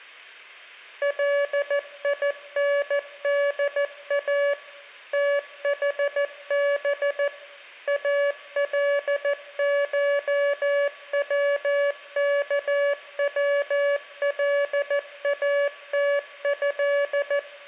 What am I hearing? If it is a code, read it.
Morse code (Arabic alphabet), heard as a keyed tone, machine-sent, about 14 wpm, 570 Hz, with room echo. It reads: ليندا تحب الشوكولاته